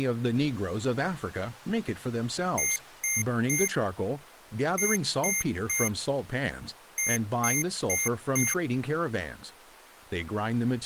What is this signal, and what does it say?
Beep code, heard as beeps from a small speaker, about 2100 Hz, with speech in English. 3-3-4. In Phoenix BIOS tables: video failure.